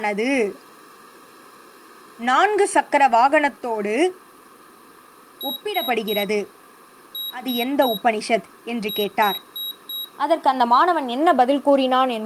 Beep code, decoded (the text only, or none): 3-3-4